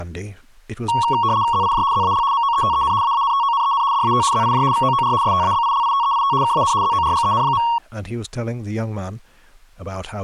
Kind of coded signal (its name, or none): RTTY